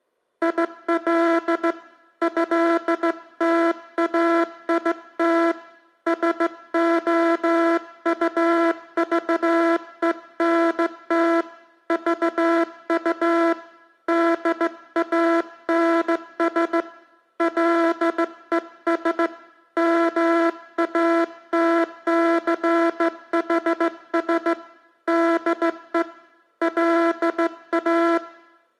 Morse code (with French letters), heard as a buzzer, hand-sent with a straight key, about 15 wpm. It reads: IL ÉTAIT SOUVENT VU DANS LES MATCHS DE LA